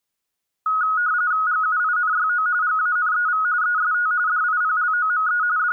RTTY (45.45 baud, 170 Hz shift), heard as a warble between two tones, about 1360 Hz centre. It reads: GUINYO GANEV EST DIPLOME …